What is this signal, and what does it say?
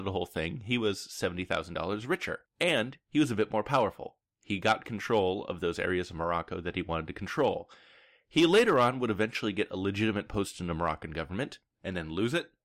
Speech in English. There is no code.